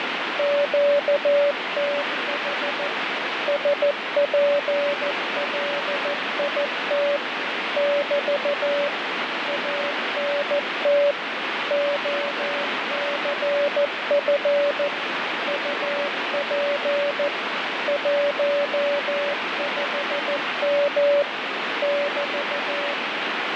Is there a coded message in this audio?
Yes: Morse code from 0.3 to 23.0 s, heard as a keyed tone, machine-sent, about 14 wpm, 570 Hz, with heavy radio static. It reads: QTH SPLIT <BT> ANT OCF UP 15M <BT>